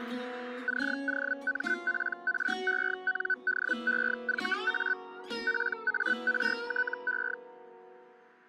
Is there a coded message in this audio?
Yes: Hellschreiber (Feld-Hell, 122.5 baud) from 0.7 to 7.3 s, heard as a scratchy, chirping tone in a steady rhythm, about 1500 Hz. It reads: COMPRENDEVA PARTE